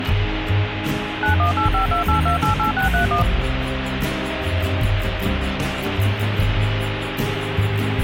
DTMF, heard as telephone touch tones, dialled by machine, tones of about 120 ms, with radio hiss. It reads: 918528288631